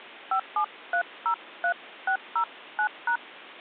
DTMF, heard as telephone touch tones, dialled by hand, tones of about 80 ms. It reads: 57303609#